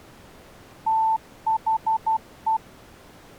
Morse code, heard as a keyed tone, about 12 wpm, 890 Hz. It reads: THE